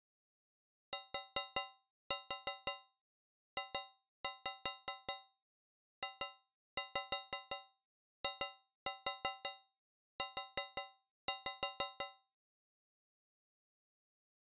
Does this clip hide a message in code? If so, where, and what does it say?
Yes: tap code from 0.9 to 12.3 s, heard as taps on a metal pipe, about 5 knocks a second. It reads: TJJIU